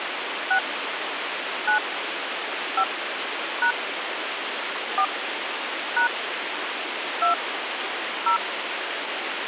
DTMF, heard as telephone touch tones, dialled by hand, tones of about 90 ms, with phone line noise. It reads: 6 9 5 # 4 # 2 0